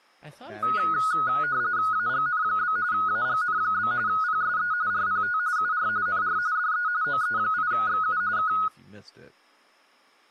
RTTY (45.45 baud, 170 Hz shift), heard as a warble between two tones, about 1360 Hz centre, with speech in English. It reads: AGN? AGN? PSE RPT UR NR DE OE8XU K